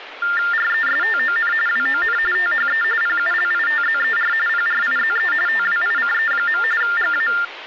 TTY/TDD text telephone tones (45.45 baud Baudot), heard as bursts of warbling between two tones, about 400 Hz shift, 1600 Hz centre, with phone line noise and speech in Gujarati. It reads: RESTON WON THE PULITZER PRIZE TWICE. GA